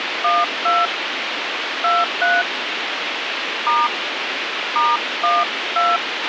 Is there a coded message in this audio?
Yes: DTMF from 0.2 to 6.0 s, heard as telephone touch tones, dialled by hand, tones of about 200 ms, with radio hiss and a squelch burst at the end. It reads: 12 23 * *12